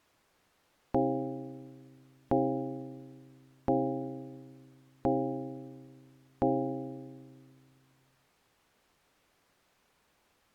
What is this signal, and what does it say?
Clock strike, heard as a bell. 5. Five o'clock.